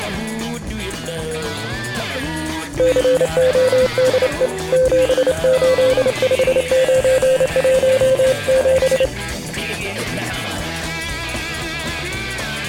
Morse code, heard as a keyed tone, hand-sent with a straight key, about 28 wpm, 520 Hz. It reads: CODE 785917